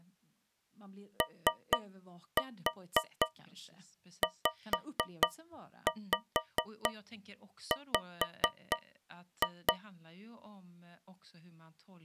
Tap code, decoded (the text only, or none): OZW